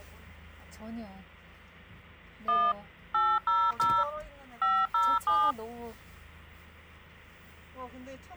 DTMF, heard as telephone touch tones, dialled by machine, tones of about 240 ms, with hum and the noise inside a car. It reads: 1 800 507